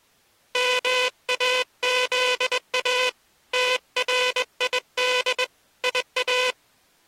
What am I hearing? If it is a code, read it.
Morse code (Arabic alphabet), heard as a buzzer, hand-sent with a straight key, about 21 wpm. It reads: ماذا تريد يا